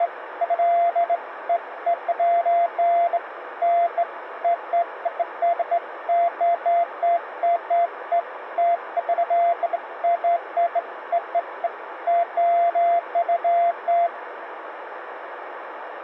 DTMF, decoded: none

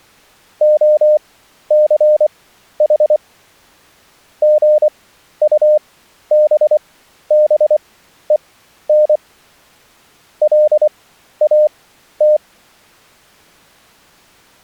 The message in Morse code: OCH GUBBEN LAT

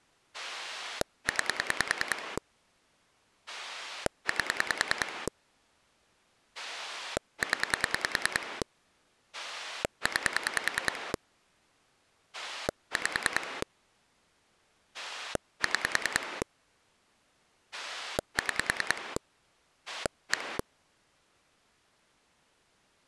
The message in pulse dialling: 9 8 0 9 5 6 6 1

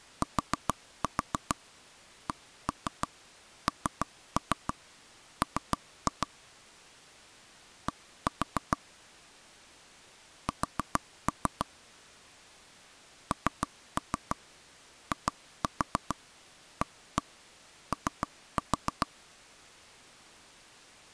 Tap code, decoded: TCNM D S NIAO

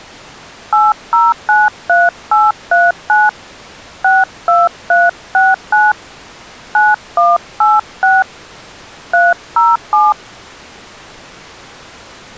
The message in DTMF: 8093839 62369 9186 307

